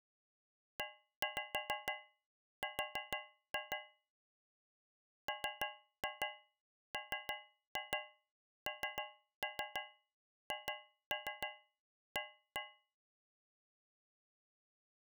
Tap code, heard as taps on a metal pipe, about 6 knocks a second. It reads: ER MMNHA